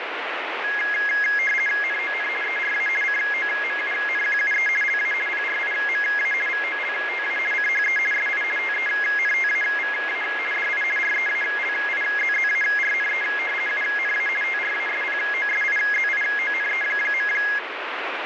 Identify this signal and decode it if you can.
RTTY (50 baud, 450 Hz shift), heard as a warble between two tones, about 1900 Hz centre, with radio static. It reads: NON ERA COMUNQUE LA PRIMA VOLTA CHE SI TENTAVA DI REALIZZARNE UNA TRASPOSIZIONE.